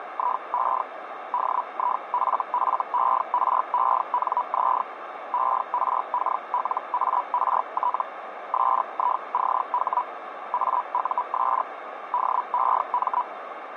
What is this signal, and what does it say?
Hellschreiber (Feld-Hell, 122.5 baud), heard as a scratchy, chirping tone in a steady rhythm, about 980 Hz, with radio static and a narrow filter. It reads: … DIFFERENZ ERKLART SICH AUS DEM